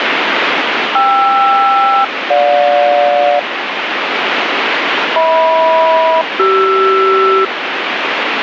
Aircraft SELCAL, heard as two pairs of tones, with radio static. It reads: KR-GJ HM-CR